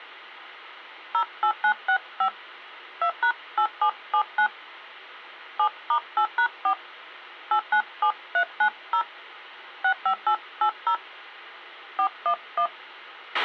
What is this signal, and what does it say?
DTMF, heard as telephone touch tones, dialled by hand, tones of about 80 ms, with a squelch burst at the end. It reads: 08965 2#8779 7*8#4 897390 65880 411